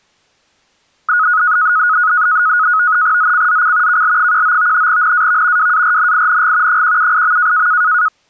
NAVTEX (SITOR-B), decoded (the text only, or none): ZCZC KL19 NAV WARNING 178.